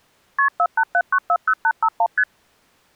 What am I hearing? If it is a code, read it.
Multi-frequency trunk signalling (R1, as on North American trunks), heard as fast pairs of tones, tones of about 60 ms. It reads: KP 487940851 ST